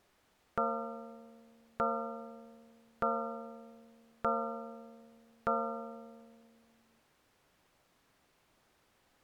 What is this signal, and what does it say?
Clock strike, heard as a bell. 5. Five o'clock.